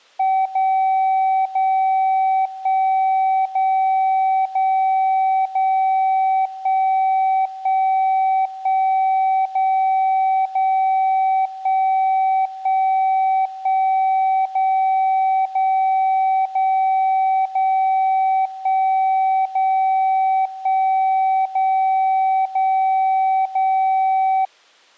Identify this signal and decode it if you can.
Radio time signal (DCF77), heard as a tone whose level steps once a second, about 760 Hz. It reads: 0 0 1 0 0 0 1 1 1 0 0 1 1 1 0 0 0 0 1 0 1 0 0 0